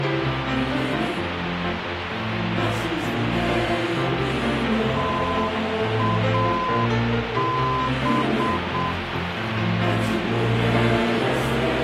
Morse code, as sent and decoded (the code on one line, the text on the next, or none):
- .- -...
TAB